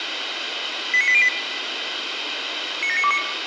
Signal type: five-tone selective call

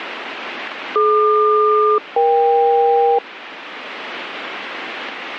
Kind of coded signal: aircraft SELCAL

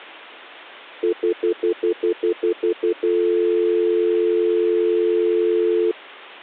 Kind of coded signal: telephone call progress tone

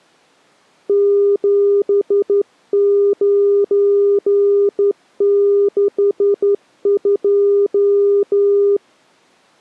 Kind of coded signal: Morse code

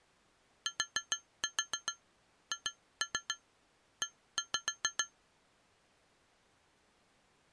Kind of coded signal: tap code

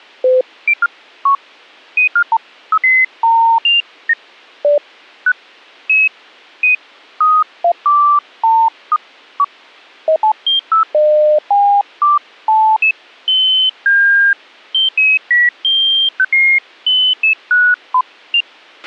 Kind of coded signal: none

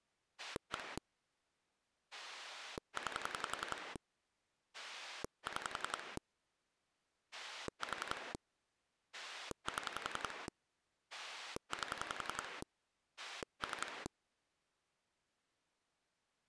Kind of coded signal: pulse dialling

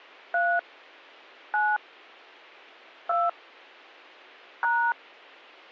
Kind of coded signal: DTMF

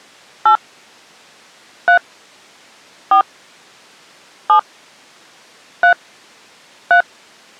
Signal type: DTMF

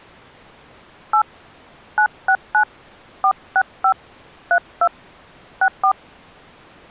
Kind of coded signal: DTMF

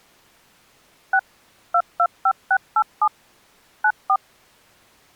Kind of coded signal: DTMF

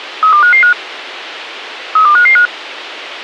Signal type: five-tone selective call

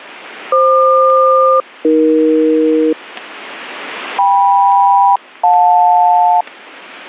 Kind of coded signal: aircraft SELCAL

